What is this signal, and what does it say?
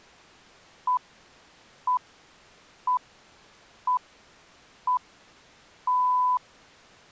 Radio time signal (six pips, as the Greenwich Time Signal), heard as pips.